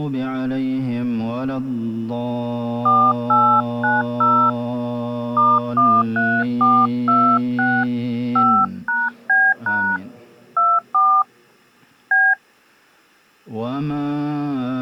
DTMF, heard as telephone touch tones, dialled by hand, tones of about 240 ms. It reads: 4890 *13426 5#B# 24 B